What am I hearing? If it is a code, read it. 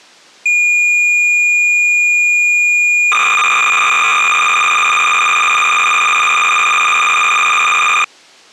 Cassette data (Kansas City type), 300 baud, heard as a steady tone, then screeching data.